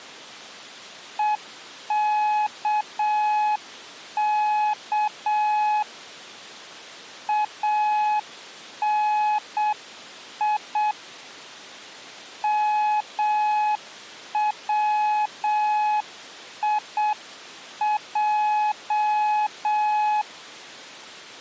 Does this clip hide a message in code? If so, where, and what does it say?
Yes: Morse code (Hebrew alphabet) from 1.1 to 20.3 s, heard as a keyed tone, hand-sent with a paddle, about 7 wpm, 850 Hz. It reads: וכך אני מציע